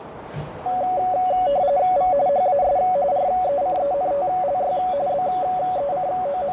RTTY (45.45 baud, 170 Hz shift), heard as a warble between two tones, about 650 Hz centre, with radio static, a narrow filter and the noise of a crowd indoors. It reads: V HAS RECENTLY …